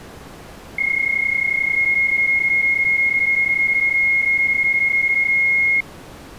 PSK31 (31.25 baud), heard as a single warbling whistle, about 2150 Hz.